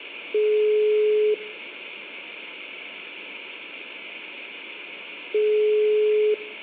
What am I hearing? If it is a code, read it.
Telephone call progress tone (single-tone plan, as in most of Europe), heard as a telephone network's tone, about 420 Hz, 1 s on and 4 s off, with room echo. Ringback tone.